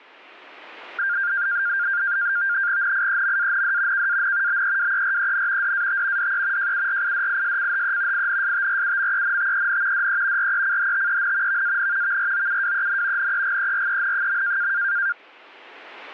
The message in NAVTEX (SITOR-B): NIEMAND KAN BEWEREN DAT DE JURIDISCHE INSTRUMENTEN DE RECHTEN VAN VROUWEN NEGEREN.

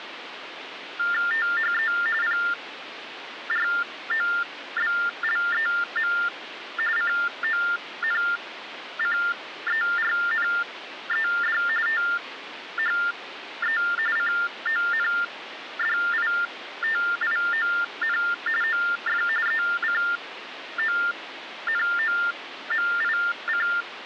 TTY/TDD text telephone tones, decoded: THE PROBLEM CONCERNED THE CONDITION OF ECONOMIC

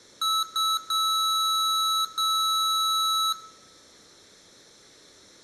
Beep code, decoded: 2 short, 2 long

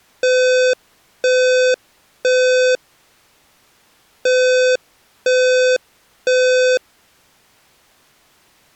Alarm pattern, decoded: temporal three

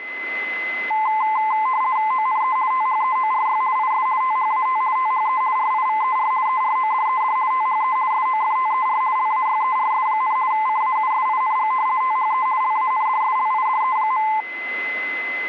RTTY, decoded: ONE THEORY IS THAT THE RIVER ERODED THE SOFTER LAYERS, CAUSING THE LANDSLIDE.

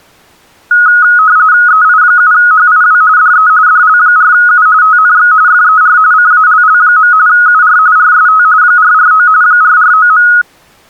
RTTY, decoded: EI7HIW DE DL4U TNX FER CALL. UR RST 449 449.

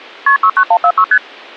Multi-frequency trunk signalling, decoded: KP 69146 ST

